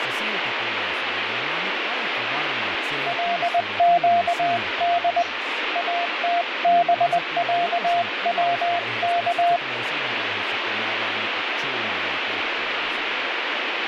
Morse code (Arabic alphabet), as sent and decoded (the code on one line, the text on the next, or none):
.-.. --.- -.. / .- - -... .-.- .-- -.-
لقد اتبعوك